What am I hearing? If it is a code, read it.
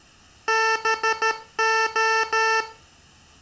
Morse code (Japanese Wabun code), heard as electronic beeps, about 13 wpm, 440 Hz, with room echo. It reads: ハレ